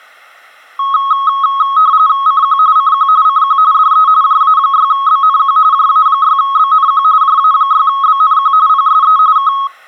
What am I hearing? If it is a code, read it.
RTTY (45.45 baud, 170 Hz shift), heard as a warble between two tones, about 1180 Hz centre. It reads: CQ CQ CQ DE JA6BNQ JA6BNQ JA6BNQ PSE K